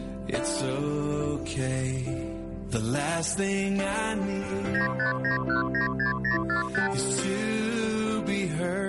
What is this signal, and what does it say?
Multi-frequency trunk signalling (R2, with the far end's replies), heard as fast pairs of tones, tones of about 120 ms. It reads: 959196045